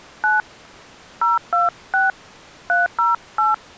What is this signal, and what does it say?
DTMF, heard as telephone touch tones, dialled by hand, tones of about 160 ms. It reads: 9 026 308